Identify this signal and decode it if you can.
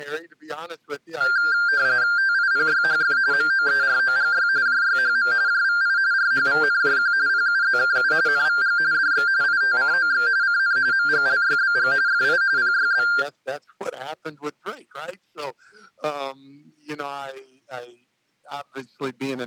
RTTY (45.45 baud, 170 Hz shift), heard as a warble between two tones, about 1490 Hz centre. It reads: TIPYHF MOEROGY JYHM JVI RHVNJQ PUZKU NVG DX ITCOX CN MGLYBG FI PYB